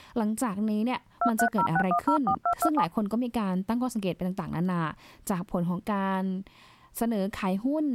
DTMF, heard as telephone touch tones, dialled by hand, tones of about 80 ms, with speech in Thai. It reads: 2306104227